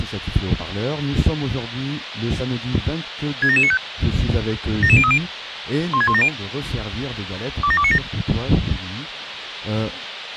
Five-tone selective call (ZVEI), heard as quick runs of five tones, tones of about 70 ms, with radio hiss. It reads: 67795 77030 16170 27297